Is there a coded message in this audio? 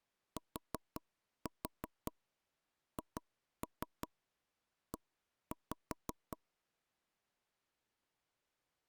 Yes: tap code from 0.4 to 6.4 s, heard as knocks on wood, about 5 knocks a second. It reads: THE